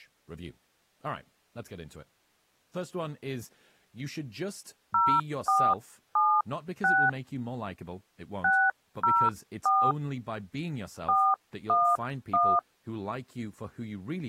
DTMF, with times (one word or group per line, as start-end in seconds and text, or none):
4.9-7.1 0476
8.4-9.9 604
11.1-12.6 411